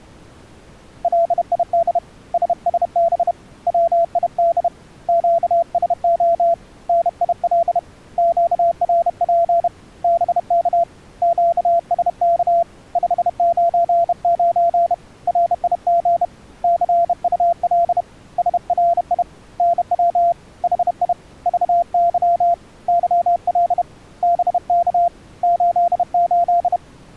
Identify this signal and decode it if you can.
Morse code, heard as a keyed tone, hand-sent with a bug key, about 31 wpm, 680 Hz. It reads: LID SSB WID QSO NIL QRP BK QSK 599 RIG CUL SRI NW HI VY YL BK 88